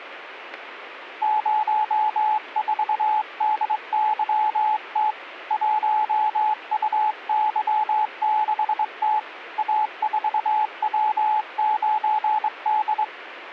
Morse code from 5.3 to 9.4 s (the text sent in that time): 1UY6T